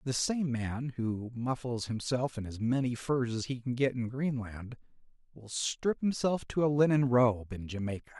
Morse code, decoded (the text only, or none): none